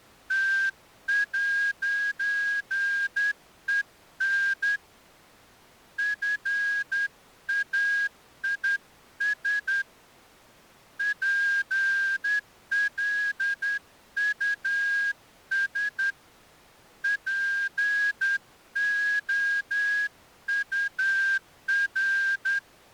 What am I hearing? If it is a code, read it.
Morse code, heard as a whistle, hand-sent with a straight key, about 10 wpm. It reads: T'EN FAIS PLUS POUR